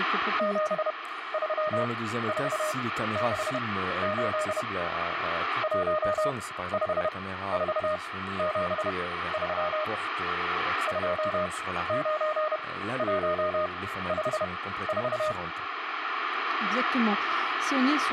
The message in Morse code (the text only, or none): 73468 15473 29154